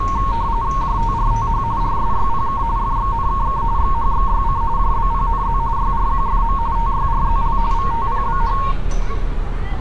RTTY (45.45 baud, 170 Hz shift), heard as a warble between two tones, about 1010 Hz centre, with street noise. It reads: JTRTH RSYPK FXNKK XHXYC JBPNZ YRQFM TYRZL VTPBH